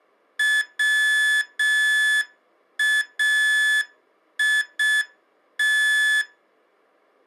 Morse code, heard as electronic beeps, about 6 wpm, 1700 Hz. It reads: WAIT